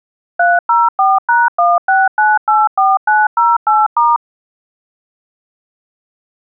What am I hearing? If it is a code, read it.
DTMF, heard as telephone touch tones, dialled by machine, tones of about 200 ms. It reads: 304#16984908*